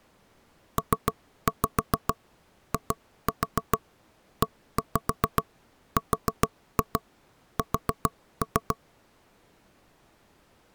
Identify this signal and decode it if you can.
Tap code, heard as knocks on wood, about 7 knocks a second. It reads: PIERS